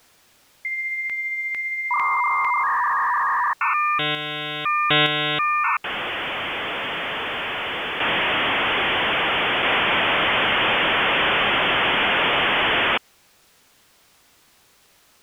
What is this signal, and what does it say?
Dial-up modem handshake (V.34 or later), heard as a whistle, warbles, then hiss.